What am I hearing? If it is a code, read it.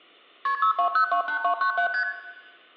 Multi-frequency trunk signalling (R1, as on North American trunks), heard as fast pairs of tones, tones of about 100 ms, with room echo. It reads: KP 62028297 ST